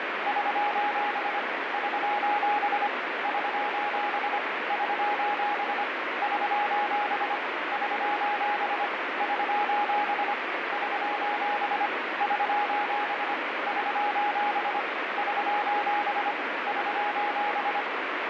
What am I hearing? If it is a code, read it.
Morse code, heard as a keyed tone, hand-sent with a paddle, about 25 wpm, 830 Hz, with heavy radio static. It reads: <SOS> <SOS> <SOS> <SOS> <SOS> <SOS> <SOS> <SOS> <SOS> <SOS> <SOS> <SOS>